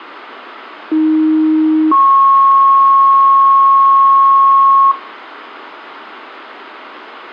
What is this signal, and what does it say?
Two-tone page, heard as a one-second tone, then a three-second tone, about 310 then 1090 Hz, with radio hiss and room echo.